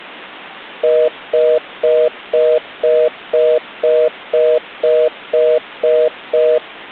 Telephone call progress tone (North American plan), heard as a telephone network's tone, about 480, 620 Hz, 0.25 s on and 0.25 s off. Congestion tone.